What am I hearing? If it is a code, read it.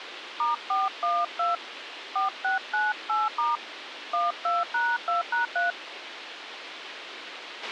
DTMF, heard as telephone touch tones, dialled by hand, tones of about 170 ms, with radio hiss and a squelch burst at the end. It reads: *412 4698* 12#2#3